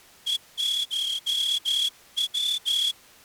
Morse code (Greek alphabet), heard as a whistle, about 14 wpm. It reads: ΕΧΩ